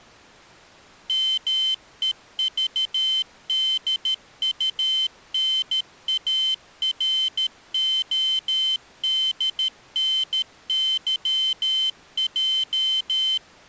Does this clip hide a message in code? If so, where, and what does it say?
Yes: Morse code (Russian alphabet) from 1.0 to 13.4 s, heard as a high beeper, machine-sent, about 13 wpm, 3100 Hz. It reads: МЕЖДУНАРОДНЫЙ